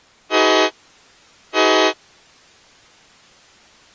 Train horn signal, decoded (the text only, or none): 2 short